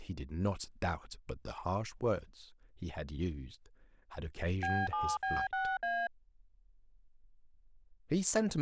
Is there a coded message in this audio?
Yes: DTMF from 4.6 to 6.1 s, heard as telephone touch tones, dialled by machine, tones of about 240 ms, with speech in English. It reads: B7B6A